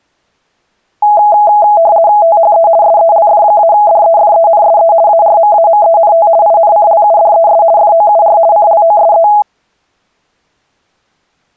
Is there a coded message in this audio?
Yes: RTTY (50 baud, 170 Hz shift) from 1.0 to 9.4 s, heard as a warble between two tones, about 750 Hz centre. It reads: THE SELF-DEFENSE ARMAMENT INCLUDES FOUR CLOSE